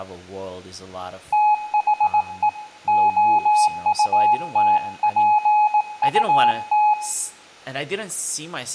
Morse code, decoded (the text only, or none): THE OUTPUT